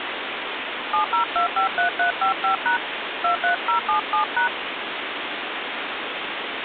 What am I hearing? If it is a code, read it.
DTMF, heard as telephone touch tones, dialled by hand, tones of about 110 ms, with phone line noise. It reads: 70253355# 23077#